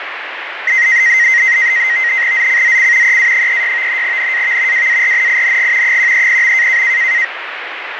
NAVTEX (SITOR-B), 100 baud, 170 Hz shift, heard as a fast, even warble, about 2000 Hz centre, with radio static and fading. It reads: ZCZC EA36 NAV WARNING 130.